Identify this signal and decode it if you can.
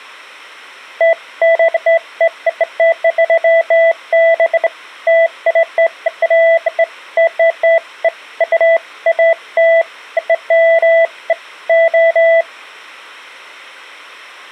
Beeps of irregular length. There is no code.